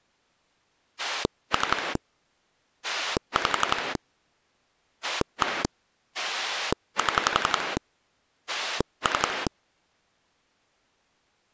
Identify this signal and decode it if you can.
Pulse dialling, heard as a rotary dial, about 11 pulses a second. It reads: 3 5 1 7 3